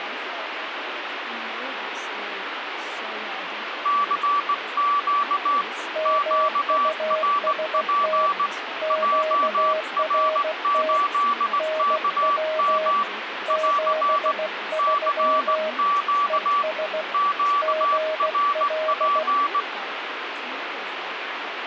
Morse code, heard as two keyed tones, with radio static and speech in English. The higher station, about 18 wpm, 1150 Hz: CQ QRP JR8KM <AR> CQ QRP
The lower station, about 16 wpm, 630 Hz: MUST QRT NW 73 ES GL